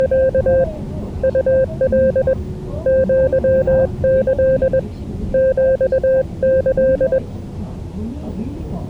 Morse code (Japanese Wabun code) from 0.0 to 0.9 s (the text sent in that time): …